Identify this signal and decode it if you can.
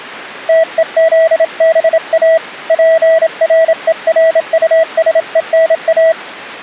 Morse code, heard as a keyed tone, hand-sent with a bug key, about 27 wpm, 650 Hz. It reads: TEZBA PRERUSENA